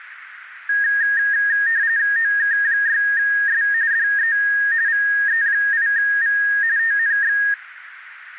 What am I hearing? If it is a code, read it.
RTTY (45.45 baud, 170 Hz shift), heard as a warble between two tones, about 1750 Hz centre, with radio static. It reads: OK6S DE VE8V TNX